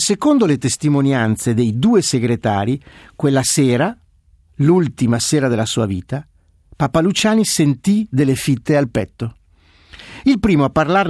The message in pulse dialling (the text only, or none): none